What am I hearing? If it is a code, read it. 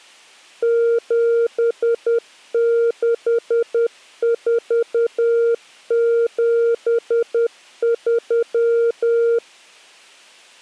Morse code, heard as a keyed tone, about 10 wpm, 470 Hz. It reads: 76473